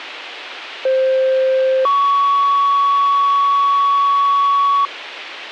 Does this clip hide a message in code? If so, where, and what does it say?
Yes: two-tone page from 0.9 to 4.9 s, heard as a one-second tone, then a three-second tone, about 520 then 1120 Hz, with radio hiss.